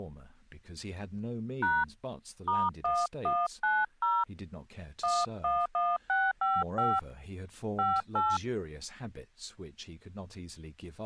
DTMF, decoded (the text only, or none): # *1190 111655 58